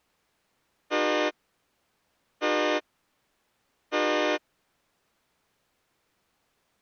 Train horn signal, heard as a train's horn. 3 short. On North American railways: when stopped, the train will back up.